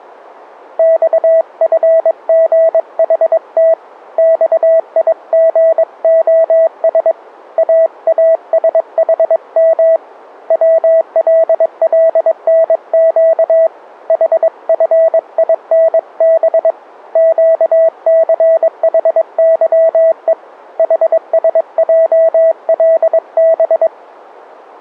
Morse code, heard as a keyed tone, hand-sent with a paddle, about 22 wpm, 650 Hz. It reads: XFGHT XIGOS AASHM WLLNQ HFINB QCHYE HSJLB